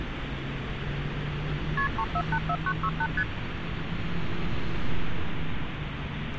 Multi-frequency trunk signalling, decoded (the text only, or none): KP 3484968 ST